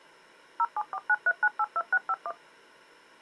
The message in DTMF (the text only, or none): 07493982651